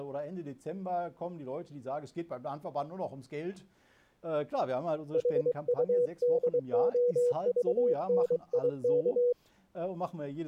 Morse code (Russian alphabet), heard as a keyed tone, hand-sent with a paddle, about 23 wpm, 490 Hz. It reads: ХУДОЖНИК